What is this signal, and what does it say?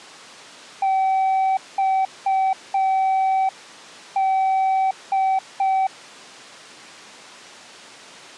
Morse code, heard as a keyed tone, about 5 wpm, 770 Hz. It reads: XD